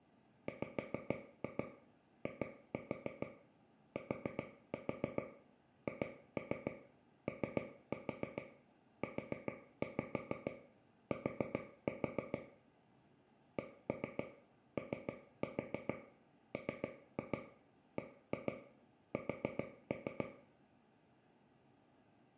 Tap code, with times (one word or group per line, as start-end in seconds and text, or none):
0.5-12.4 WITHOUT
13.6-20.3 COMBS